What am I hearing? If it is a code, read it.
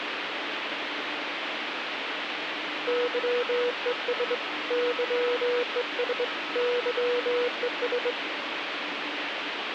Morse code, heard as a keyed tone, hand-sent with a straight key, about 22 wpm, 490 Hz, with radio static and the noise inside a subway train. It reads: YES YES YES